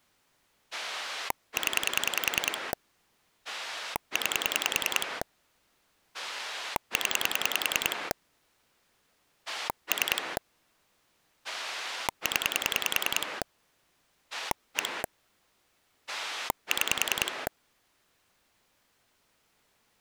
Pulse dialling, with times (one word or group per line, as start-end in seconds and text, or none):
0.7-2.7 0
3.5-5.2 9
6.1-8.1 0
9.5-10.4 3
11.4-13.4 0
14.3-15.0 1
16.1-17.5 6